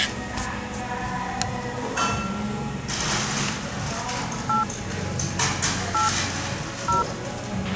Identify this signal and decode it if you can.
DTMF, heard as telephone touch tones, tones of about 140 ms, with a squelch burst at the end and the noise of a cafe. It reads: 8 8 0